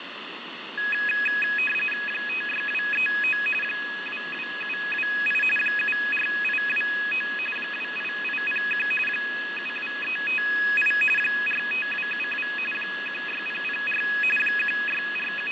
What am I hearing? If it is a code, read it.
RTTY (45.45 baud, 850 Hz shift), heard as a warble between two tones, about 2100 Hz centre, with radio static and fading. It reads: 56239 22728 74829 28801 72358 45272 16004 …